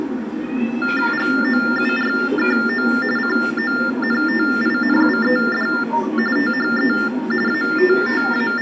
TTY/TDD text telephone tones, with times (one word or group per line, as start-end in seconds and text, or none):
1.1-2.9 GOURKO
3.2-5.7 CONTINUED
6.4-6.9 THE
7.5-8.6 …